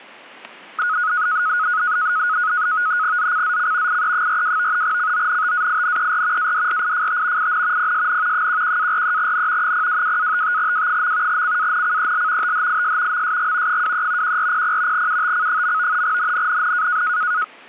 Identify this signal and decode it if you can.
NAVTEX (SITOR-B), 100 baud, 170 Hz shift, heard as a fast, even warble, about 1360 Hz centre, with static crashes. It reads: ZCZC IE42 CONTAINER ADRIFT IN PSN 11-43N 022-55W. CANCEL THIS MSG 23 1400 UTC. NNNN